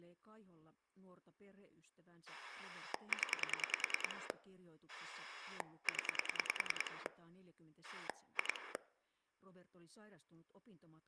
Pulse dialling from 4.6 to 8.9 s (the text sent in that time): 0 2